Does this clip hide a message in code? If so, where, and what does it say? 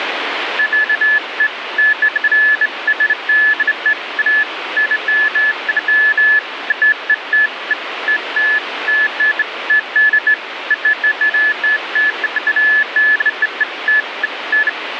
No, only beeps of irregular length, with radio static.